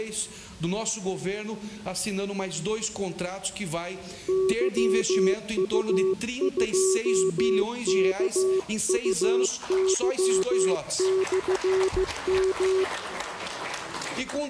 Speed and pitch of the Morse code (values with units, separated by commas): 15 wpm, 380 Hz